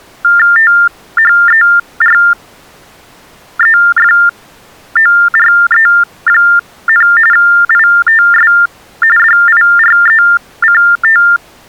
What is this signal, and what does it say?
TTY/TDD text telephone tones (45.45 baud Baudot), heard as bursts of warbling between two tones, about 400 Hz shift, 1600 Hz centre. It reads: THEREFORE, ITS DIRECT